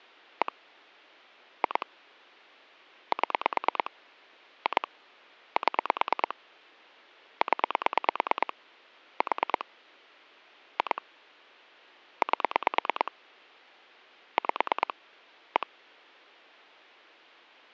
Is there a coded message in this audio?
Yes: pulse dialling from 0.4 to 15.6 s, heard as clicks on a phone line, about 9 pulses a second. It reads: 1 2 7 2 7 0 4 2 8 5 1